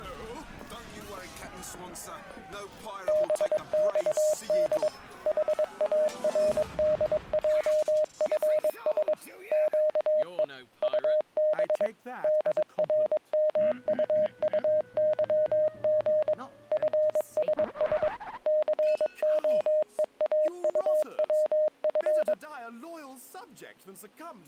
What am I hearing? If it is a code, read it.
Morse code, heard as a keyed tone, machine-sent, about 22 wpm, 610 Hz. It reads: BXD HARDJFS QE UB DRMUUYG FSS COEAUWF